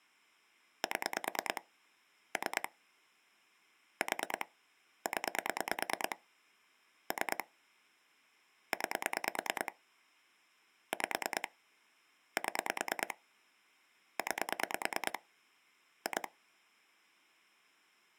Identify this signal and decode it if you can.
Pulse dialling, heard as clicks on a phone line, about 9 pulses a second. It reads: 7 3 4 0 3 9 5 7 9 2